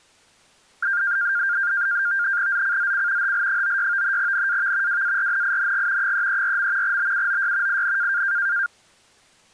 NAVTEX (SITOR-B), 100 baud, 170 Hz shift, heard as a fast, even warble, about 1500 Hz centre. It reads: ZCZC HL96 NAV WARNING 334. BUOY IN